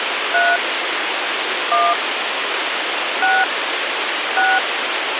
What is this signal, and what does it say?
DTMF, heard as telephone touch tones, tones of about 220 ms, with radio hiss. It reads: 3 1 6 6